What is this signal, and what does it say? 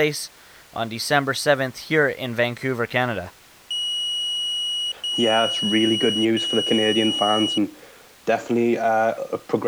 Beep code, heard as a piezo beeper, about 2900 Hz, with speech in English. 3 long. In IBM BIOS tables: keyboard card error.